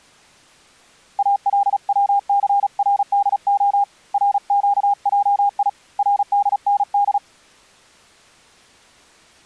Morse code (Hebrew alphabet), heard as a keyed tone, hand-sent with a paddle, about 36 wpm, 810 Hz. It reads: אלצסרדה רקעי רדנד